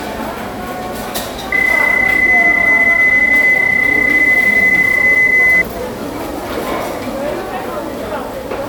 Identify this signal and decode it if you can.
PSK31 (31.25 baud), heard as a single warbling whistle, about 2000 Hz, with the noise of a restaurant.